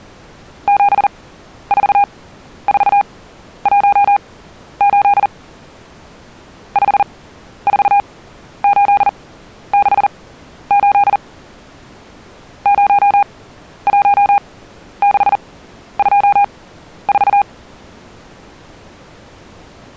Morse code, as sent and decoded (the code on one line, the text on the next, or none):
--... ....- ....- .---- ---.. / ..... ....- ---.. -.... ---.. / ----- .---- -.... ..--- ....-
74418 54868 01624